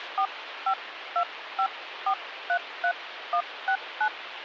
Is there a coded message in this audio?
Yes: DTMF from 0.2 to 4.1 s, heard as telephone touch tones, dialled by hand, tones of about 80 ms, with phone line noise. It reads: 4525433169